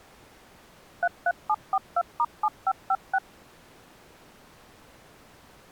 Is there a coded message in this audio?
Yes: DTMF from 1.0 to 3.2 s, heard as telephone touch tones, dialled by machine, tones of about 50 ms. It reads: 33742*7556